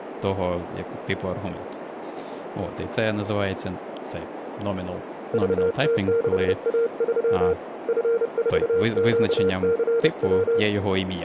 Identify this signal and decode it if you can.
Morse code, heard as a keyed tone, hand-sent with a paddle, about 30 wpm, 460 Hz, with radio static, a narrow filter and speech in Ukrainian. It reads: VT6A3 F4QCW